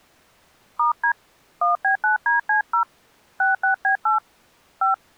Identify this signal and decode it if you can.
DTMF, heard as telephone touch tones, dialled by hand, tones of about 120 ms. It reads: *D 1B9DC0 66B8 5